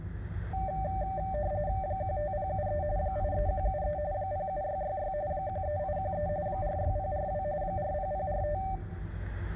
RTTY (45.45 baud, 170 Hz shift), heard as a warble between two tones, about 680 Hz centre, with static crashes and the noise inside a car. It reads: 15073 83173 07666 13813 46042 40045